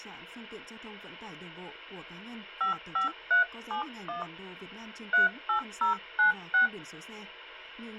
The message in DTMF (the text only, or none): 55371 38096